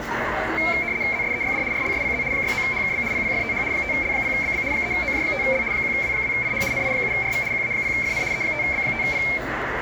RTTY (75 baud, 170 Hz shift), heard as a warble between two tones, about 2250 Hz centre, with radio static and the noise of a crowd indoors. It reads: ZSEYD RLSPZ 69HKB PPFTH 5L0BB 3OJ5L 1W2IH NI7RV QA0FN E5B5P